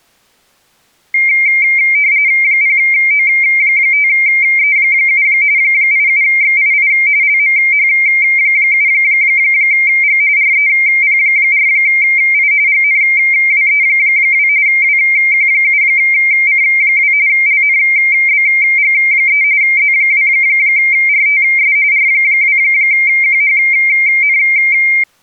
RTTY (45.45 baud, 170 Hz shift), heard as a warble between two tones, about 2200 Hz centre. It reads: 0O5E7 87XII LMH7G REP4I GNWE2 WQ7C2 LNBG3 Z2RTS R2QHN